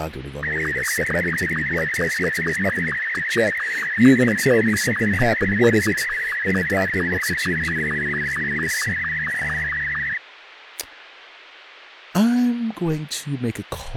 SSTV (slow-scan television), Martin M2, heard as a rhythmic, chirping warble, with radio hiss and speech in English.